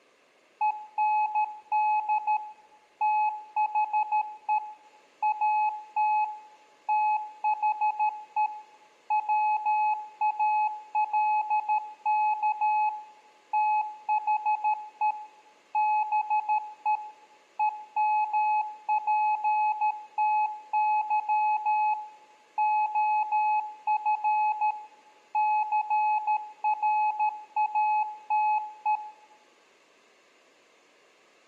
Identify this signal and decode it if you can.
Morse code, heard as a keyed tone, machine-sent, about 13 wpm, 850 Hz, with room echo. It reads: END THE AT THE WALK THE BE EMPTY OF CRATE